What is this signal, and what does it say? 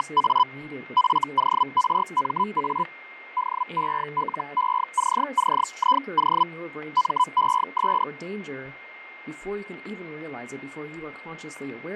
Hellschreiber (Feld-Hell, 122.5 baud), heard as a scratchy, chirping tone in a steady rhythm, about 1000 Hz, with fading, a steady whistle near 2120 Hz and speech in English. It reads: … FORMA DELECCIO MES